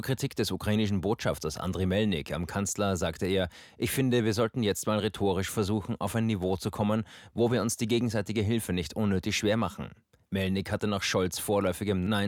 Speech in German. There is no code.